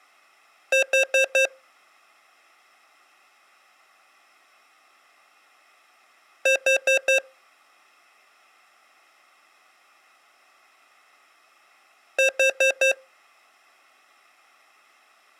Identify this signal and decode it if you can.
Alarm pattern, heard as an alarm's beeps, played three times, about 530 Hz. Temporal four. Carbon monoxide.